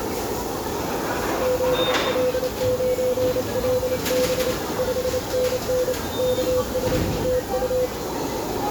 Morse code, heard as a keyed tone, hand-sent with a paddle, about 28 wpm, 500 Hz, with radio static, a narrow filter and the noise of a restaurant. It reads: ZL9LB 5NN KS TU